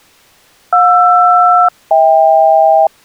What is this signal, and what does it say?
Aircraft SELCAL, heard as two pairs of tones. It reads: JR-HK